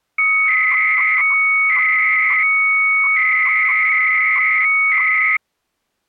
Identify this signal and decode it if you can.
300-baud modem data (Bell 103 tones), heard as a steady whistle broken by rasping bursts, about 300 baud, 200 Hz shift.